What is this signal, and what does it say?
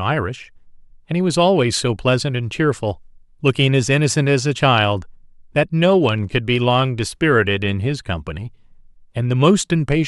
Speech in English. There is no code.